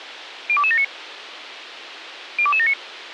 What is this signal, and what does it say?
Five-tone selective call (ZVEI), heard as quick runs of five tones, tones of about 70 ms, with radio hiss. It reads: 02279 02279